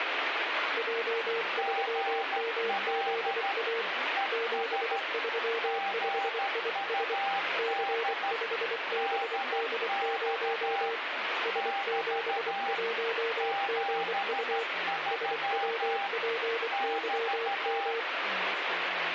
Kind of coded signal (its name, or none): Morse code